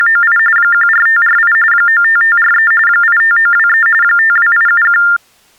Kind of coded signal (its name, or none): TTY/TDD text telephone tones